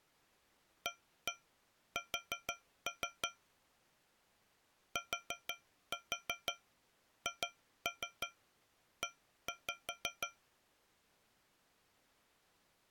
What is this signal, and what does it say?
Tap code, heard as taps on a metal pipe, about 6 knocks a second. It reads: AS THE